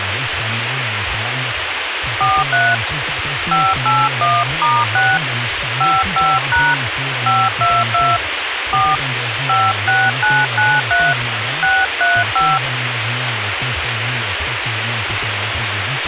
DTMF, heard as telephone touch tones, dialled by hand, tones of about 220 ms, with radio hiss. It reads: 43 581*6 55# 522 4 56993 635